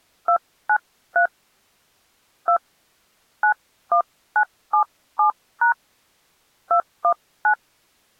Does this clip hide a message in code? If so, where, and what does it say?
Yes: DTMF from 0.3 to 7.5 s, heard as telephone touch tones, dialled by hand, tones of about 90 ms. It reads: 293 2 91977# 219